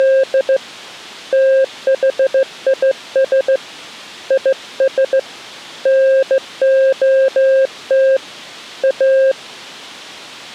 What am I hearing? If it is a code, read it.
Morse code, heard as a keyed tone, hand-sent with a straight key, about 15 wpm, 530 Hz. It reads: … THIS IS NOT A